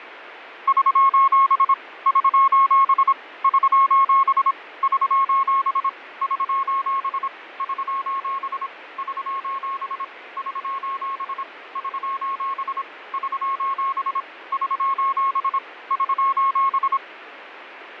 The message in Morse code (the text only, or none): <SOS> <SOS> <SOS> <SOS> <SOS> <SOS> <SOS> <SOS> <SOS> <SOS> <SOS> <SOS>